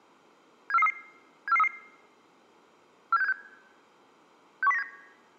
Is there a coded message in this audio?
Yes: five-tone selective call (EEA) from 0.7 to 4.8 s, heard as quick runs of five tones, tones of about 40 ms. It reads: 74433 74433 47676 61097